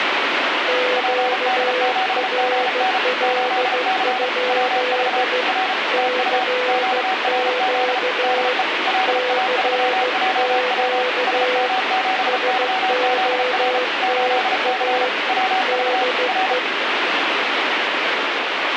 Morse code, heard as two keyed tones, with heavy radio static. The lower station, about 15 wpm, 500 Hz: QRL? CQ CQ SOTA DE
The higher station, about 34 wpm, 760 Hz: PD7GN 8C WV R TU QRZ DE LA3JW SM7YZR 8C WV R